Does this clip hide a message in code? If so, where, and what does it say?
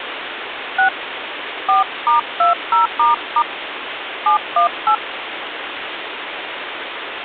Yes: DTMF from 0.8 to 5.0 s, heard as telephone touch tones, dialled by hand, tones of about 110 ms, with phone line noise. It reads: 6 4*20** 718